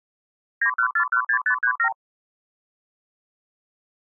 Multi-frequency trunk signalling (R2, with the far end's replies), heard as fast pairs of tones, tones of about 80 ms. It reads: 91416537